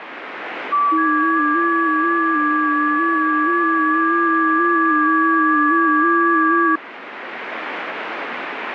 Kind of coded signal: FT8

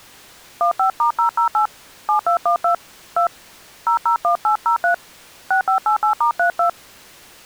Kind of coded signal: DTMF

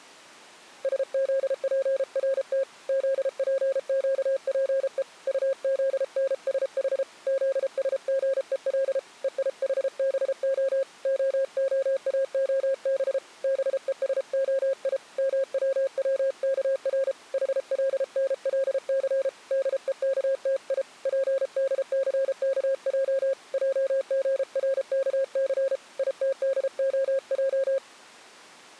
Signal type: Morse code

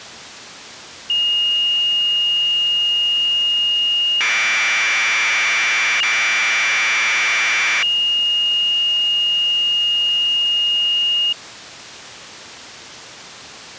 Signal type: Commodore tape loading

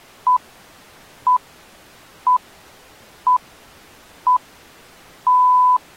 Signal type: radio time signal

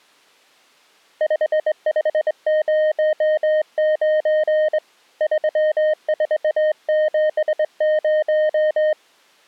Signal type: Morse code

